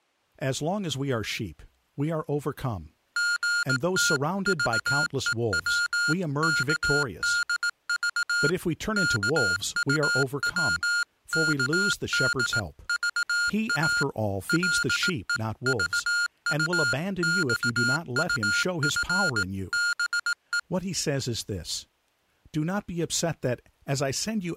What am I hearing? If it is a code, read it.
Morse code (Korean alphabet), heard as electronic beeps, machine-sent, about 18 wpm, 1420 Hz, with speech in English. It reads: 서랍을 입으로 가리킨다